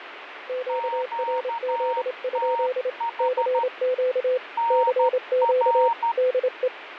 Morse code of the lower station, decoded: QRZ? CQ CQ DE

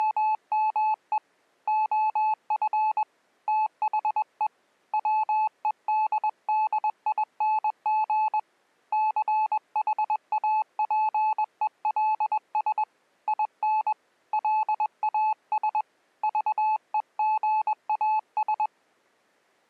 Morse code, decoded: … OF THE WEDDING CHAPELS IN LAS VEGAS

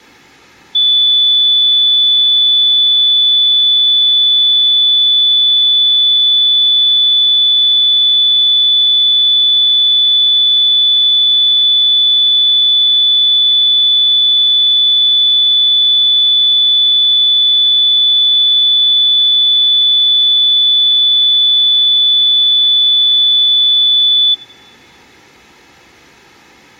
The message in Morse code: none

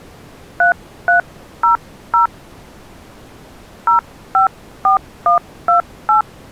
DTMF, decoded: 3300 054128

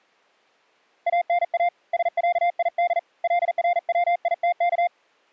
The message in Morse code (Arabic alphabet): انا سعيد لرويتك

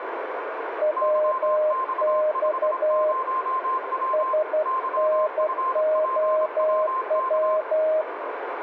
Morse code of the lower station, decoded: WX SNOW

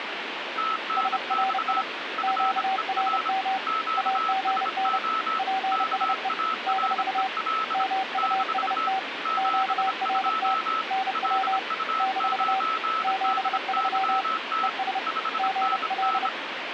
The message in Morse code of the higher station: TNX FER QSO KAREL - 72 LU9DYT 5NN

